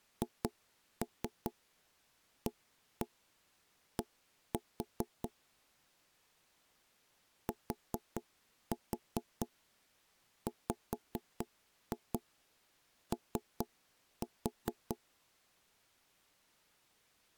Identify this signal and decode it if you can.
Tap code, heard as knocks on wood, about 4 knocks a second. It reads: HAD TWO